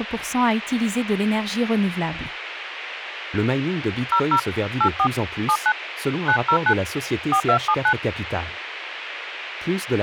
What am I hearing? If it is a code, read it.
DTMF, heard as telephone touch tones, dialled by hand, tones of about 80 ms, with radio hiss and speech in French. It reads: 00 84 79 909 4279